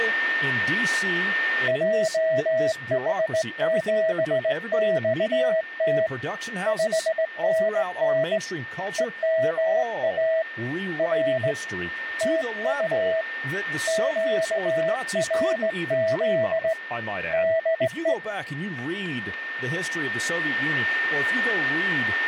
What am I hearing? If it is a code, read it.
Morse code, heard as a keyed tone, hand-sent with a straight key, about 18 wpm, 650 Hz, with a steady whistle near 1810 Hz and speech in English. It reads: JH7XT 5NN EMA R TU QRZ DE